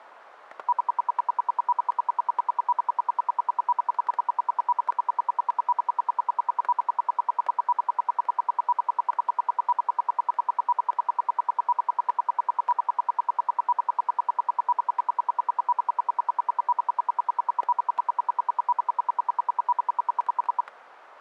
Radio time signal (RWM, Moscow), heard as ten pulses a second, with static crashes.